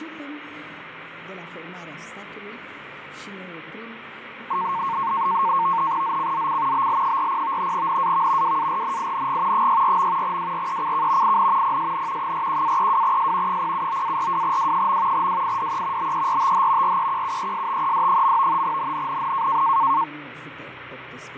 NAVTEX (SITOR-B), 100 baud, 170 Hz shift, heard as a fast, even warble, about 1000 Hz centre, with radio static and fading. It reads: ZCZC BL40 NAV WARNING 64. WRECK IN PSN 41-32S 079-42W. WIDE BERTH REQUESTED. NNNN